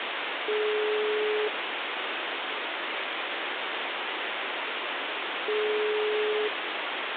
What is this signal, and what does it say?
Telephone call progress tone (single-tone plan, as in most of Europe), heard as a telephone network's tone, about 420 Hz, 1 s on and 4 s off, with phone line noise. Ringback tone.